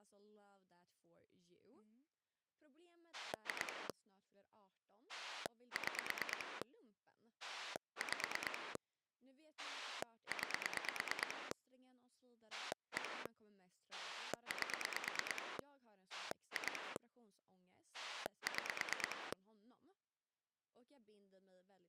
Pulse dialling, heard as a rotary dial, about 9 pulses a second, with speech in Swedish. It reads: 2 6 5 9 1 8 2 6